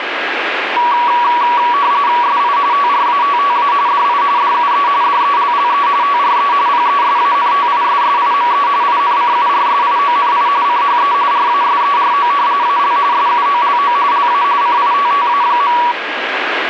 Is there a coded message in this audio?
Yes: RTTY (45.45 baud, 170 Hz shift) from 0.8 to 15.9 s, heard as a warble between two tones, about 1050 Hz centre, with radio static. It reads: SI TRATTA DI DUE DELLE TRE PESANTISSIME INCURSIONI CHE RASERO AL SUOLO LA CITTA.